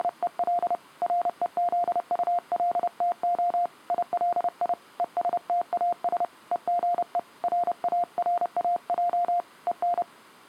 Morse code, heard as a keyed tone, hand-sent with a paddle, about 30 wpm, 700 Hz. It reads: … REZULTO ILI ESTAS EGE RARAJ EN